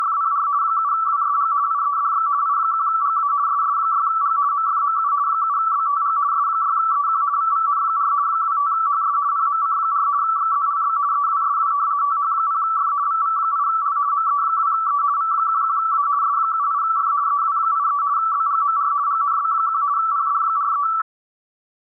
RTTY (50 baud, 170 Hz shift), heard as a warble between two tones, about 1230 Hz centre. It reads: … 7WSG IEDX I1GA SS6G MFMU 7BTG S6EQ VVN4 25HS PMC4 XZLB EWSW TH0F VV8L ME2E V11A S78F EW83 BGMR GNB1 PD43